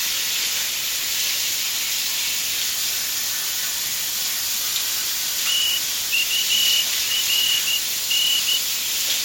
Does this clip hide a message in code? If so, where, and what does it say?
Yes: Morse code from 5.4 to 8.6 s, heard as a whistle, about 13 wpm, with the noise of a restroom. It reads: TURN